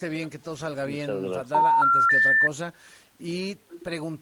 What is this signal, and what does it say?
Telephone call progress tone (North American plan), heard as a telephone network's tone, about 910, 1370, 1800 Hz. Special information tone.